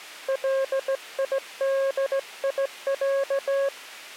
Morse code (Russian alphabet), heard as a keyed tone, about 16 wpm, 540 Hz. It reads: ЛИДИЯ